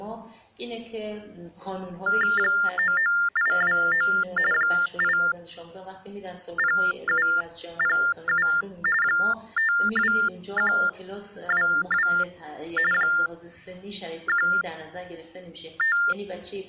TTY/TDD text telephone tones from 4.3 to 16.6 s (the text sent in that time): 80707 52122 …